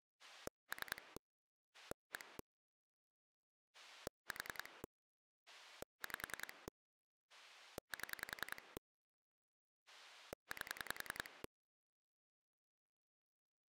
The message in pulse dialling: 3 1 4 5 7 8

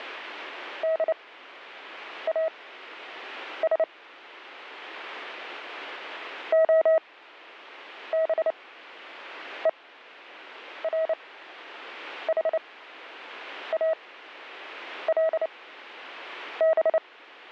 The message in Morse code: DAS OBERHALB

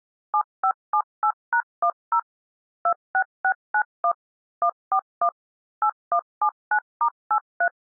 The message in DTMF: 7578#10 26691 141 8179*83

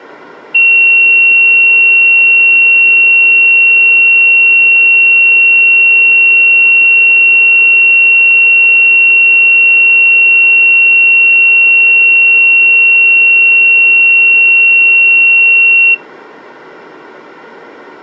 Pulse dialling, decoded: none

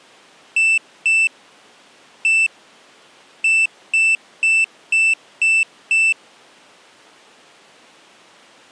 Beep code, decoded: 2-1-6

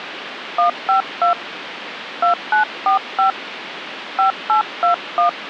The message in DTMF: 152 2945 5821

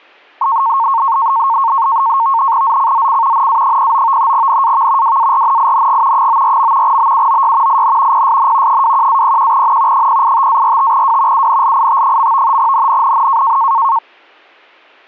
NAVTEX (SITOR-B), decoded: ZCZC NA09 NAV WARNING 94. BUOY IN PSN 21-01N 085-45W UNLIT. NNNN

